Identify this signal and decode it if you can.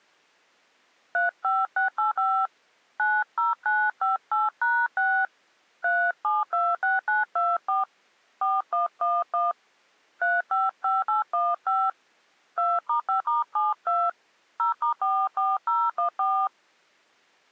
DTMF, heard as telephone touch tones, dialled by hand, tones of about 190 ms. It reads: 35685 90958#6 3726924 4111 355815 2*5*72 0*44014